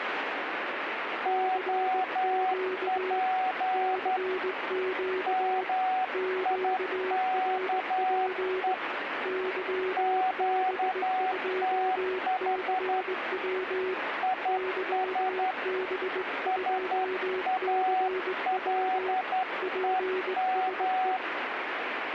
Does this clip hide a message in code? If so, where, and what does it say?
Yes: Morse code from 1.2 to 21.2 s, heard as two keyed tones, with radio static. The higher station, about 11 wpm, 750 Hz: OP MIKE QTH IS SALEM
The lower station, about 19 wpm, 370 Hz: CQ CQ QRP YB2CW YB2CW PSE